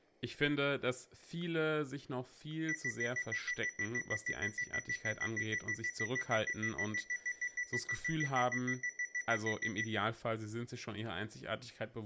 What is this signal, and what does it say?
Evenly repeated beeps, with room echo and speech in German. There is no code.